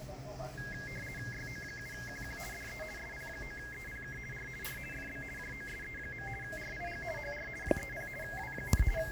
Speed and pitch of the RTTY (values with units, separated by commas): 50 baud, 450 Hz shift, 1900 Hz centre